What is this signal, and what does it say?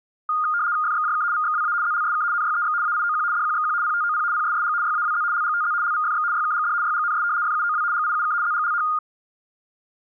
RTTY (75 baud, 170 Hz shift), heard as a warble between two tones, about 1320 Hz centre. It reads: FXJK VXWA ZLSK NYEX AIOQ DQXQ PTOP PSSG YAWZ LGTZ LVFX YKGD YGNS FUOW GIUK ZGLH